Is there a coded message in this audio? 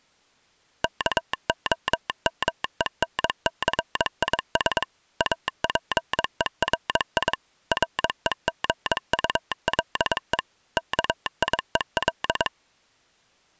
Yes: Morse code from 0.8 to 12.5 s, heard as a telegraph sounder, machine-sent, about 22 wpm. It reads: KOMENCIS APERI REGULE KIEL